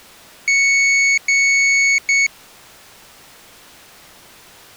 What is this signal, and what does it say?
Beep code, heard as a piezo beeper, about 2200 Hz. 2 long, 1 short.